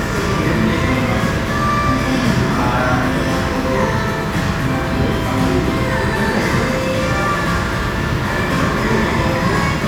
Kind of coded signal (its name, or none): none